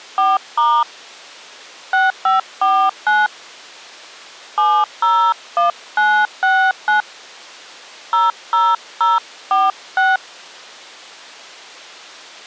DTMF, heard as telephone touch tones, dialled by hand, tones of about 210 ms. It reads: 4* 6549 701969 00046